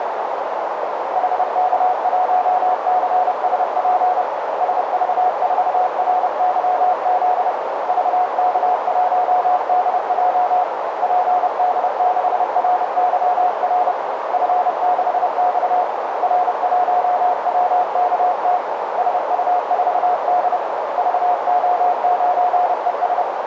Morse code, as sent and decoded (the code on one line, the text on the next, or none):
.... -.- .---- -.-. ... .--. / ... ...- ....- .-. -.-- --.. / ...- -.- .---- -.. .--- / .--. -.. -.... .-. -.-- .-. / ..-. -.... -..- / .-. .---- .-- -.- - / ... ..- ....- -.. / ...- --- ----. . ...
HK1CSP SV4RYZ VK1DJ PD6RYR F6X R1WKT SU4D VO9ES